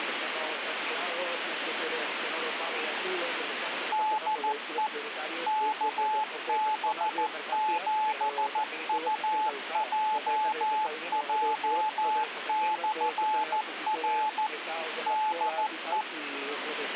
Morse code, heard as a keyed tone, machine-sent, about 14 wpm, 860 Hz, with radio static. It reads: DE KB7UJJ/R DE